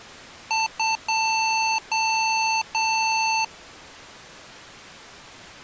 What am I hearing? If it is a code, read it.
Beep code, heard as beeps from a small speaker, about 890 Hz. 2 short, 3 long.